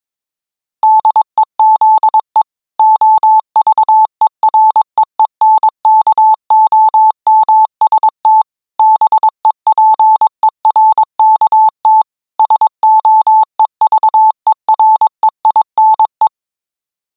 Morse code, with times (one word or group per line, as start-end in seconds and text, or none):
0.8-2.4 DEZE
2.8-8.4 OVEREENKOMST
8.8-12.0 BEPERKT
12.4-16.3 SOEVEREINE